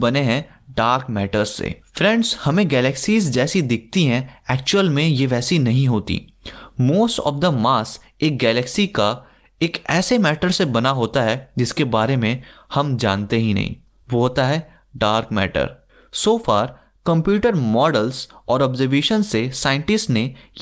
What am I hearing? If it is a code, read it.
Speech in Hindi. There is no code.